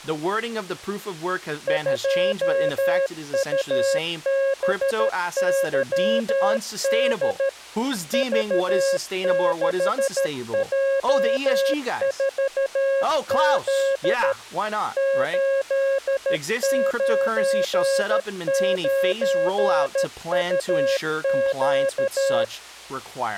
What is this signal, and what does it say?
Morse code, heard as a keyed tone, machine-sent, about 13 wpm, 540 Hz, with speech in English. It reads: 2UBYD V6J4Z 899UQ